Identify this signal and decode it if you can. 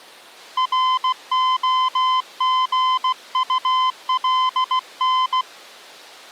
Morse code (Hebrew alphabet), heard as a keyed tone, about 16 wpm, 1030 Hz. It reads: רהגטלן